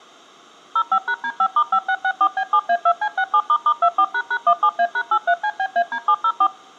DTMF, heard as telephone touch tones, dialled by machine, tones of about 70 ms. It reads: 05#D5*5664B7A2C67**24##17A#83CBAD704